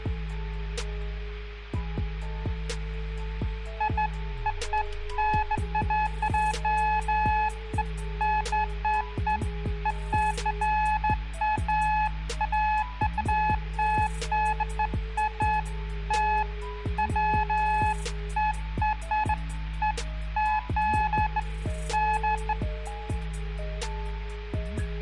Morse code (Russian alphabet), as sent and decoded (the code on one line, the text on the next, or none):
none